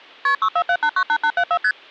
Multi-frequency trunk signalling (R1, as on North American trunks), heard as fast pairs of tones, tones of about 70 ms. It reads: KP 647898874 ST